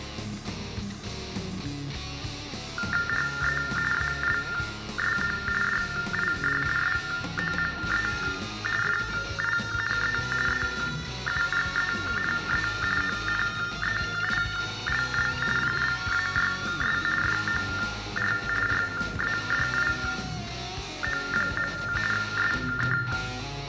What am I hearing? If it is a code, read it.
TTY/TDD text telephone tones (45.45 baud Baudot), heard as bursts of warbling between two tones, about 400 Hz shift, 1600 Hz centre, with room echo. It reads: HE ALSO DID SOME FINE EUGENE ONEILL PLAYS FOR RADIO. SK